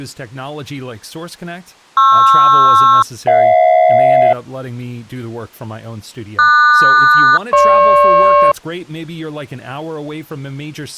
Aircraft SELCAL, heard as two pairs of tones, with speech in English. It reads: PR-HJ QS-GP